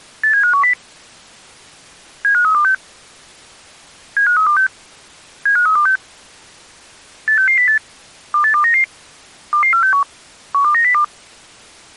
Five-tone selective call (CCIR), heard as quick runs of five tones, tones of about 100 ms. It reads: 87510 75326 75326 75326 86608 28299 22461 12902